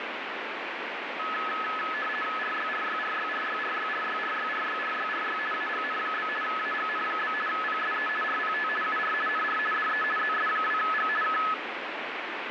RTTY (50 baud, 450 Hz shift), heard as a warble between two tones, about 1500 Hz centre, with radio static. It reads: RYRYRYRYRYRYRYRYRYRY AGN? AGN? PSE RPT UR NR DE ZS2G K